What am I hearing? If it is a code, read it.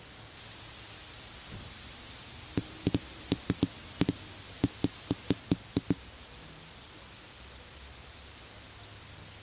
Irregular knocks on a wall, with the noise of a residential street. There is no code.